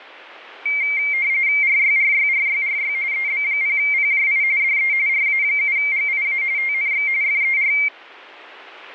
RTTY (45.45 baud, 170 Hz shift), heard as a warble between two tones, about 2200 Hz centre. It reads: RYRYRYRY EB0PJI DE RA7GIA TNX FER